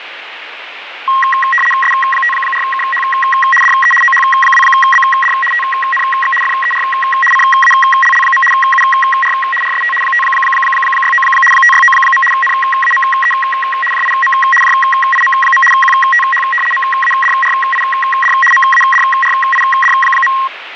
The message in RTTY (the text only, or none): S54KH DE OH2BD TNX FER CALL. UR RST 569 569. NAME JIM JIM. QTH MADRID MADRID.